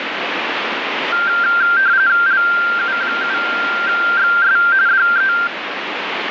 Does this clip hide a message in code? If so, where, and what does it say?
Yes: RTTY (45.45 baud, 170 Hz shift) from 1.1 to 5.5 s, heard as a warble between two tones, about 1480 Hz centre, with radio static. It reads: LU7XS DE